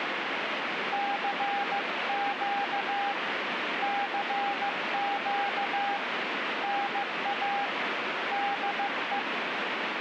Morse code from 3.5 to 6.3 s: CQ

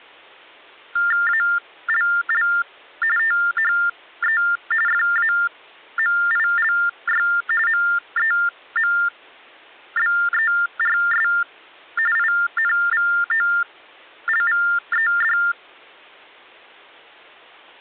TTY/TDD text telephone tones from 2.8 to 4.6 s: THE

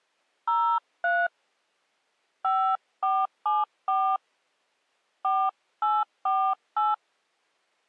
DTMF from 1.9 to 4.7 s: 5474

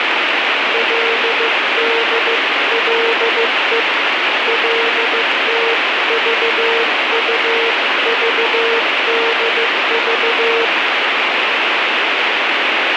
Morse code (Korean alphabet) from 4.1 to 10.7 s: 거리를

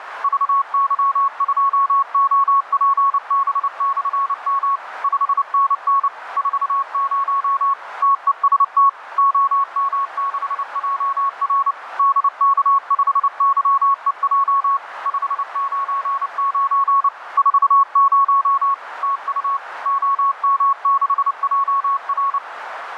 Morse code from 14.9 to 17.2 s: 599

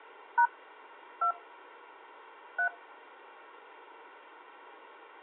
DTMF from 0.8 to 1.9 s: 2

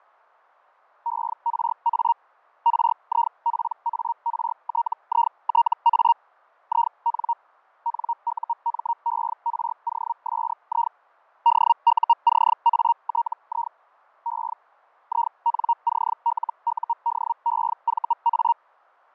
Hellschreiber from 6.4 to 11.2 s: IN NUMEROSI

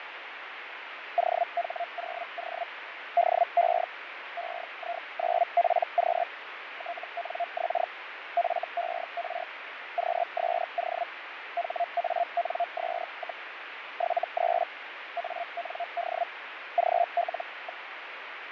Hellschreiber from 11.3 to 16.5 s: HANS, 73 AND

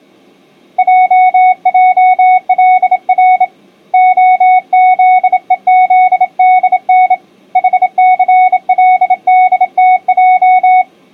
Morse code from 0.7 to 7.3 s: JJLR OZEZDN

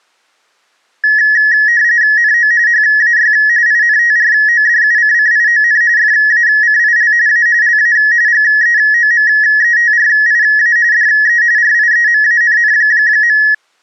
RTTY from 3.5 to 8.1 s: INTRODUCCION FACIL A LA

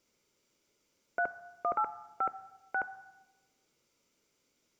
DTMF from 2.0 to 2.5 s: 5

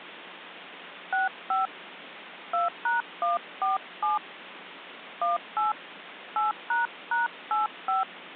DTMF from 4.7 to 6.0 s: 18

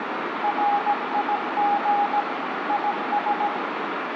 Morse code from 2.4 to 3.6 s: IS

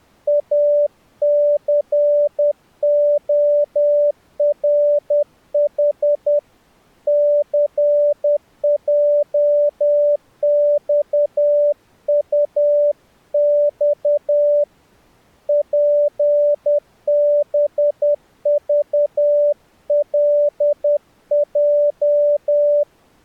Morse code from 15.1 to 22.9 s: PBVLJ

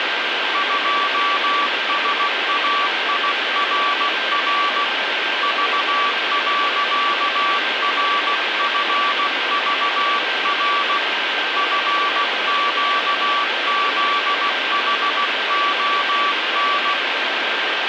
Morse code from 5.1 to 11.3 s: V.RFVR

